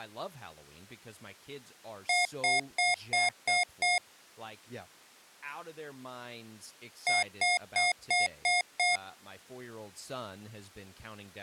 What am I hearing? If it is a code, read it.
Beep code, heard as beeps from a small speaker, played twice, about 720 Hz, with speech in English. 6 short. In AMI BIOS tables: keyboard controller gate A20 failure; in Dell tables: video card failure.